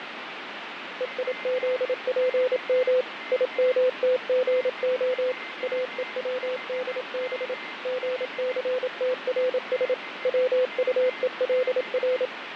Morse code (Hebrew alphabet), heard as a keyed tone, machine-sent, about 27 wpm, 510 Hz, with radio static, fading and a weaker station near 2080 Hz. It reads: ויזפם ימתגה אוצדב גסתרש צטולר